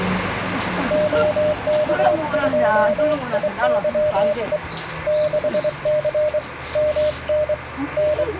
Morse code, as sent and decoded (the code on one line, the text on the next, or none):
--- -.- ..--- .. -.-- . / -.... -.-. / -- -. / …
OK2IYE 6C MN …